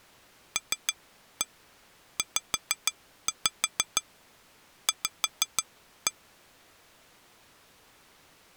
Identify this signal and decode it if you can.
Tap code, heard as taps on glass, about 6 knocks a second. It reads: LZV